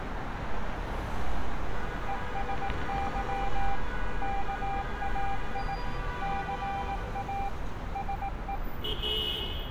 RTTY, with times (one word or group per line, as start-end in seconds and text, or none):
none